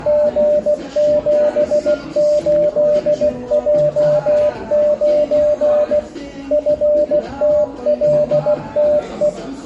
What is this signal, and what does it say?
Morse code, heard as a keyed tone, machine-sent, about 16 wpm, 600 Hz, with room echo and the noise of a cafe. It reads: G78J9 FTLTE